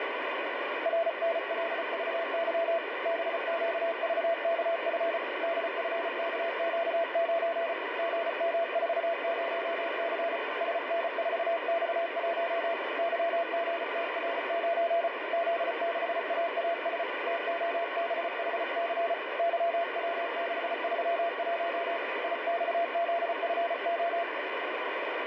Morse code, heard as a keyed tone, hand-sent with a paddle, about 34 wpm, 680 Hz, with heavy radio static. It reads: RNLVY BQVKF DFKQ9 GM40C SN4X1 YGTR9 Z6AAS TOBHC YW631 IXZFO